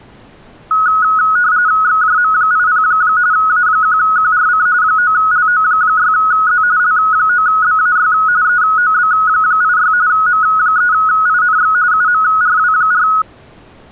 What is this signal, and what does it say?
RTTY (45.45 baud, 170 Hz shift), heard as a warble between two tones, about 1370 Hz centre. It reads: XJM80 A1QRC 9LO6Z L9BAY EOB86 M3INX UMRW4